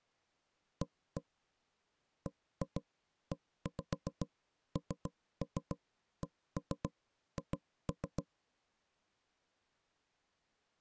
Tap code, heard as knocks on wood, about 7 knocks a second. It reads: A BENCH